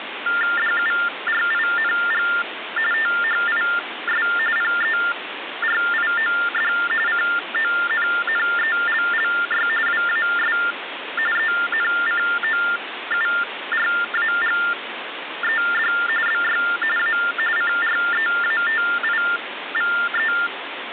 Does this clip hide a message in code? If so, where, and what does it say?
Yes: TTY/TDD text telephone tones (45.45 baud Baudot) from 0.3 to 20.5 s, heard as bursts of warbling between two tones, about 400 Hz shift, 1600 Hz centre, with phone line noise. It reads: DURING THIS PERIOD CONNELLY WAS ENCOURAGED BY A CREATIVE